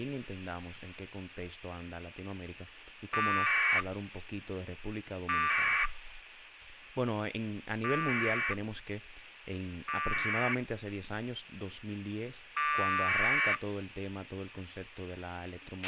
Packet radio (AX.25, as in APRS), 1200 baud, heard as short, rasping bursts, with a squelch burst at the end and speech in Spanish.